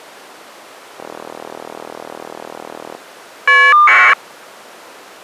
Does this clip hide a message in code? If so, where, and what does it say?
Yes: caller ID data burst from 1.0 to 4.1 s, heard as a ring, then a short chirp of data, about 1200 baud.